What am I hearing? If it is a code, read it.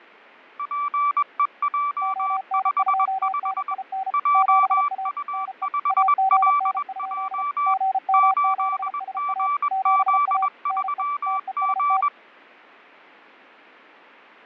Morse code, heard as two keyed tones, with fading. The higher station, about 21 wpm, 1160 Hz: PEJ55 JU5LJ 8GZ3G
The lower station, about 34 wpm, 770 Hz: ON2NIN 7A NE AGN? GM7SA 7A NE TEST